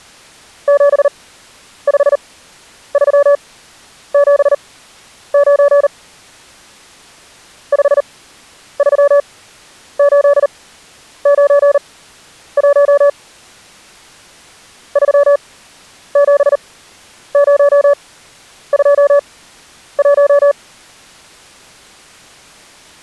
Morse code, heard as a keyed tone, machine-sent, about 39 wpm, spaced as for 10 wpm, 570 Hz. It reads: 75379 53891 37021